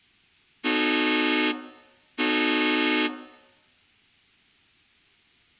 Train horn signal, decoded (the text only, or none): 2 short